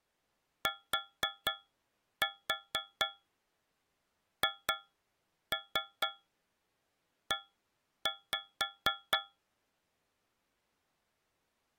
Tap code, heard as taps on a metal pipe, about 4 knocks a second. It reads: THE